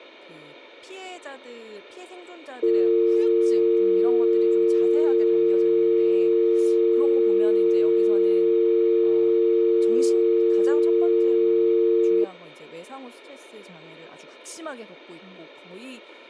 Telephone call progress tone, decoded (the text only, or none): dial tone